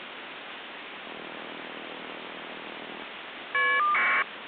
Caller ID data burst, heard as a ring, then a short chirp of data, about 1200 baud, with phone line noise.